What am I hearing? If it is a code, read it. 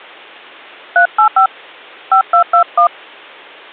DTMF, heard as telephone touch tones, dialled by hand, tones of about 100 ms. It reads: 385 5221